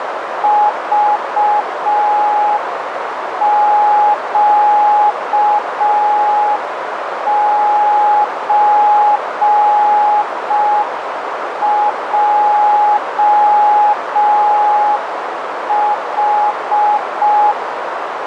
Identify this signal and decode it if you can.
Morse code (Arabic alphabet), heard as a keyed tone, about 5 wpm, 840 Hz, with radio static and a narrow filter. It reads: ضقزجح